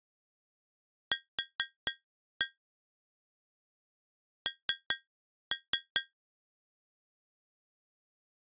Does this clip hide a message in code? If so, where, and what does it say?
Yes: tap code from 1.1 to 6.1 s, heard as taps on glass, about 4 knocks a second. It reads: Q N